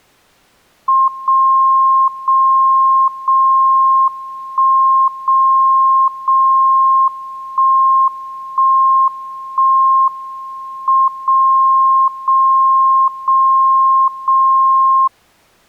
Radio time signal (WWVB), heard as a tone whose level steps once a second, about 1060 Hz. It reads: 0 0 0 1 0 0 1 1 1 M 0 0 0 0